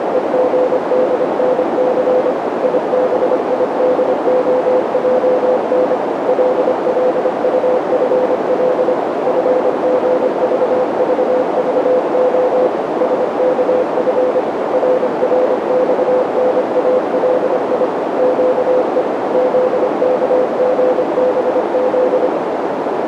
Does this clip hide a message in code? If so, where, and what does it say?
Yes: Morse code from 0.0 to 22.3 s, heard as a keyed tone, machine-sent, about 25 wpm, 510 Hz, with heavy radio static and a narrow filter. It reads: … IBIDOJN LLUFL FGVVVO SKF RRXNALI QE ZKGBZ